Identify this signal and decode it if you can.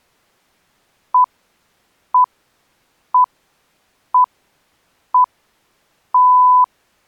Radio time signal (six pips, as the Greenwich Time Signal), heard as pips.